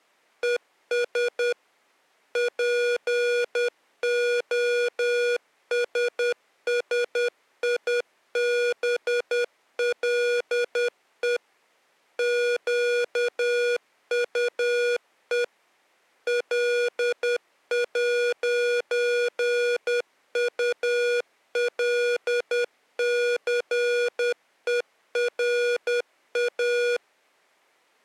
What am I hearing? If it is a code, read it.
Morse code, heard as electronic beeps, machine-sent, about 10 wpm, 480 Hz. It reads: ES POSSIBLE QUE L'ULCERA